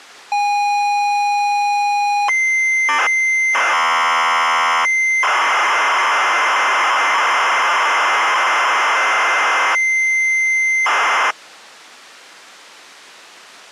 ZX Spectrum tape loading, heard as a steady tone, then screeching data.